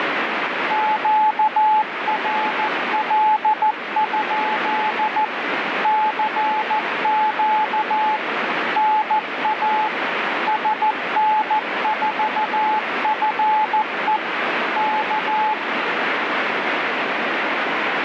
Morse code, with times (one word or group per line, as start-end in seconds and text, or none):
0.7-5.2 QRL?
5.8-8.2 CQ
8.8-9.9 NA
10.5-14.2 SN4FE
14.8-15.5 K